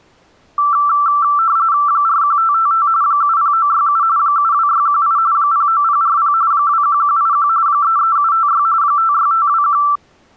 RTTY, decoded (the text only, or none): 41555 70967 72618 09040 21181 33756 56521